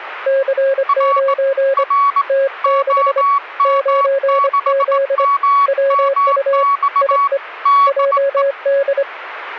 Morse code, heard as two keyed tones. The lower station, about 25 wpm, 550 Hz: C9 T6 9Z WU IE JD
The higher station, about 18 wpm, 1120 Hz: R R OM6MMX DE